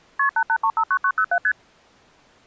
Multi-frequency trunk signalling (R1, as on North American trunks), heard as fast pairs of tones, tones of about 70 ms. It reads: KP 88359907 ST